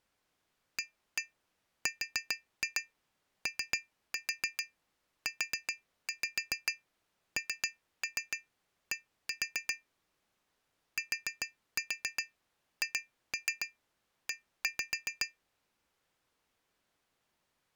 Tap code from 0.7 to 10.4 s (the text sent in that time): AROUND